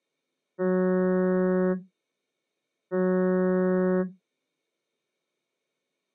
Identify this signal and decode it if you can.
Ship horn signal, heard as a ship's horn, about 180 Hz. 2 short. At sea: I am altering course to port.